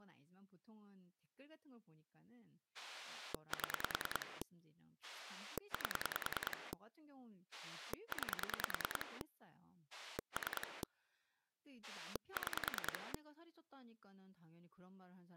Pulse dialling, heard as a rotary dial, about 10 pulses a second, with speech in Korean. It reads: 7 8 9 3 6